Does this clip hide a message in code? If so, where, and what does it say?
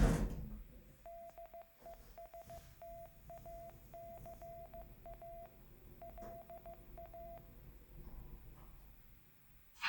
Yes: Morse code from 1.0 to 7.4 s, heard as a keyed tone, machine-sent, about 15 wpm, 680 Hz, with room echo and the noise inside a lift. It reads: DESTACA LA